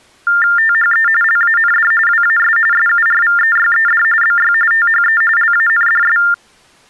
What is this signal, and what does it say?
TTY/TDD text telephone tones (45.45 baud Baudot), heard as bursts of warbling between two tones, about 400 Hz shift, 1600 Hz centre. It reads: THE LAND WAS SURVEYED BY THE LANDS